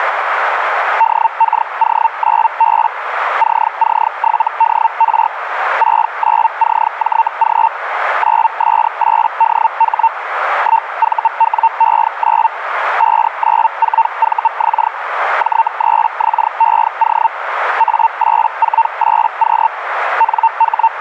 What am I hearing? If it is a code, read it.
Hellschreiber (Feld-Hell, 122.5 baud), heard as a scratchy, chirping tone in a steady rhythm, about 910 Hz, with radio static and a narrow filter. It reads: DKO9B CC7DR 69CJG 9S8DH 1VWE9 594VX J3XEO A848Q …